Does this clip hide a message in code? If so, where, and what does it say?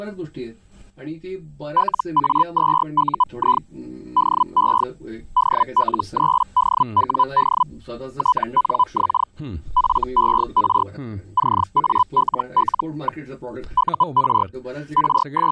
Yes: Hellschreiber (Feld-Hell, 122.5 baud) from 1.8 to 15.5 s, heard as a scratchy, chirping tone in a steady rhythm, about 1000 Hz. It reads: LA2UI DE DL3DWD TNX FER CALL. UR …